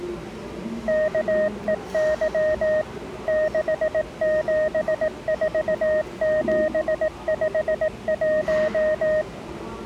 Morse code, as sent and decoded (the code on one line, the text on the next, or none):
-.- . -.-- / -.... --... ....- --... ..... .----
KEY 674751